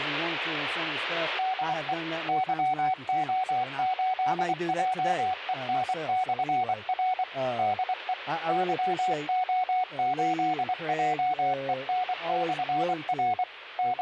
Morse code, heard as a keyed tone, machine-sent, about 24 wpm, 740 Hz, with radio static. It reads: DE YO8JEN/R DE YO8JEN/R …